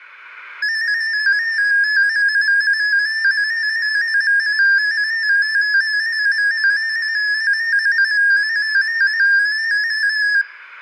Multi-tone FSK (Olivia or MFSK type), about 250 Hz wide, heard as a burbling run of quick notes, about 15.625 baud, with room echo.